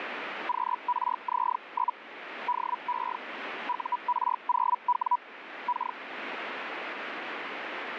Hellschreiber (Feld-Hell, 122.5 baud), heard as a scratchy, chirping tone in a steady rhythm, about 980 Hz, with radio static. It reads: QRZ? DE UR0W K